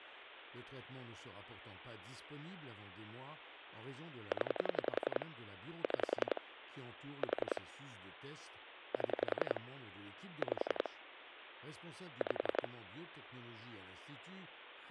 Pulse dialling, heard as clicks on a phone line, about 11 pulses a second, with speech in French. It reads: 0 6 4 7 5 5